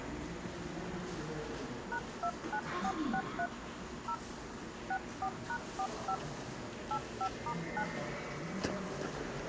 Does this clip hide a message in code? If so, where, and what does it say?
Yes: DTMF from 1.9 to 7.8 s, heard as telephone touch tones, dialled by hand, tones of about 70 ms, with the noise of a subway station. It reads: #29463 0 64#45 85*9